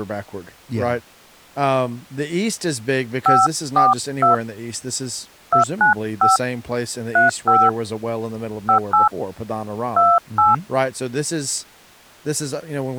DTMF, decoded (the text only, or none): 542 295 35 58 28